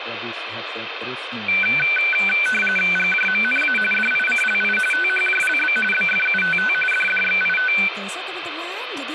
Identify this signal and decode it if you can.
RTTY (45.45 baud, 850 Hz shift), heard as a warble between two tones, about 1950 Hz centre, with radio static and speech in Indonesian. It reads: GJMNA DICLI THJLB BFUTT DDXIT